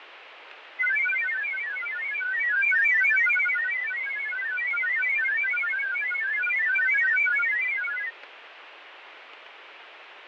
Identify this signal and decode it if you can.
Multi-tone FSK (Olivia or MFSK type), about 1000 Hz wide, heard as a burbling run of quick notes, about 31.25 baud, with radio static and fading.